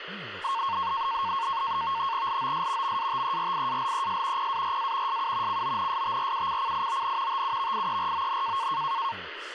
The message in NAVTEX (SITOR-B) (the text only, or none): LOS MATERIALES PARA SU CONSTRUCCION TUVIERON